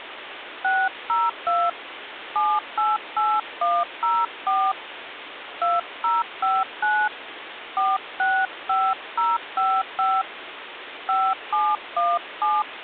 DTMF, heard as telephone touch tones, dialled by hand, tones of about 220 ms, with phone line noise. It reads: 602 788104 2059 465055 5717